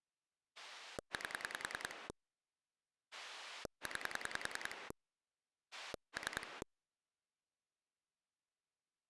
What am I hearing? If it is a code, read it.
Pulse dialling, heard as a rotary dial, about 10 pulses a second. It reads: 8 9 3